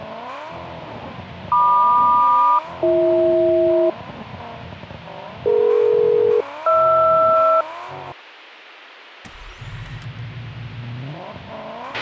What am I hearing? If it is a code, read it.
Aircraft SELCAL, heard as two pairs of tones, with a squelch burst at the end. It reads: MQ-BH DE-HR